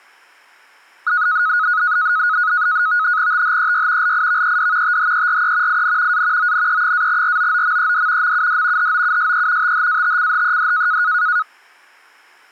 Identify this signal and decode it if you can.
NAVTEX (SITOR-B), 100 baud, 170 Hz shift, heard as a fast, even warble, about 1360 Hz centre. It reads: THEY LIVED THERE IN A ONE-ROOMED MUD HOUSE THATCHED